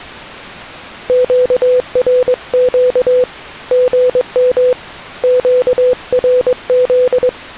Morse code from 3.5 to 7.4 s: GM QRZ

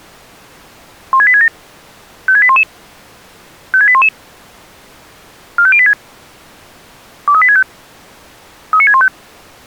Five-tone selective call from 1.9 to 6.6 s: 56811 56811 45086

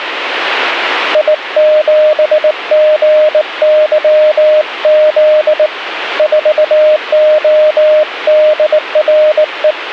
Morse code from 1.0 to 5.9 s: I7GYZ

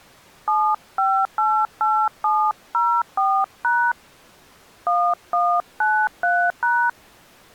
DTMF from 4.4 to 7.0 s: 1193#

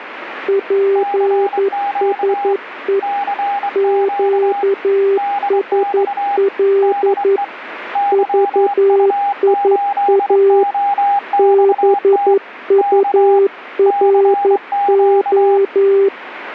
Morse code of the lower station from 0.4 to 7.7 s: PSE QSL

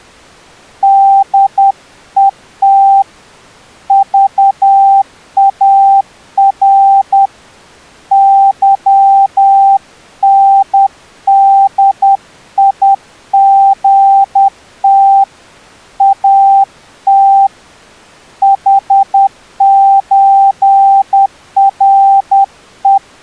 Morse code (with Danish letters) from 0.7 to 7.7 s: DET VAR

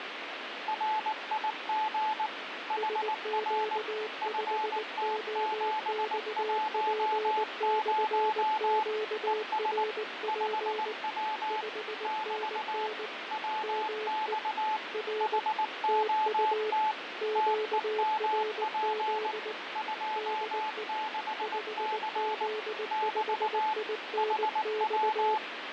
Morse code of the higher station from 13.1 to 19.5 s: WX HOT TEMP

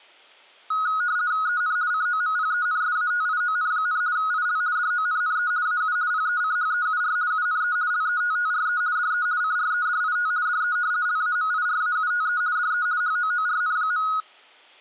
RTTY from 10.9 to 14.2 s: LAMIRAUTE DE HOORN.

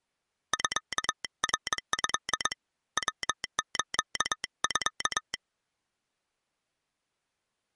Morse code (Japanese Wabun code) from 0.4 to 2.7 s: ミナト

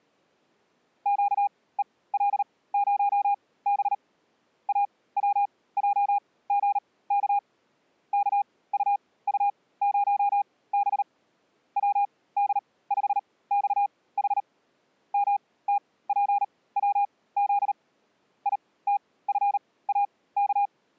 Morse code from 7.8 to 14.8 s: KUU0B WD5XH

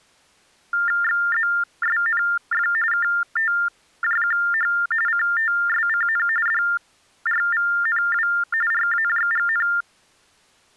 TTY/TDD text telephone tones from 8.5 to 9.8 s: RAJGN

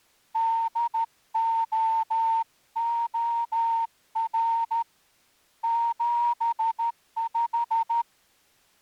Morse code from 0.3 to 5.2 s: DOOR

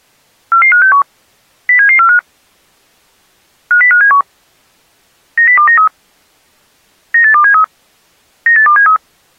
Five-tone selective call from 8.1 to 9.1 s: 98273

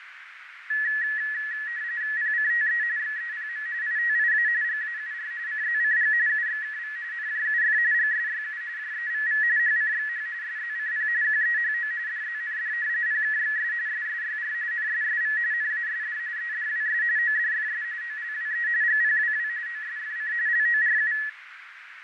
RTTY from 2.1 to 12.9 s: PCTE XEPM ITIA GAUR CZCG UXKV NJUF GSYU JEVV HCXH SZCP QEHO DZND

